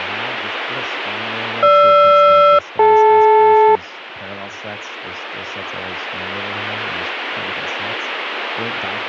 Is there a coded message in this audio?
Yes: aircraft SELCAL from 1.6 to 3.8 s, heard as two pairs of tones, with speech in English. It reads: GR-DL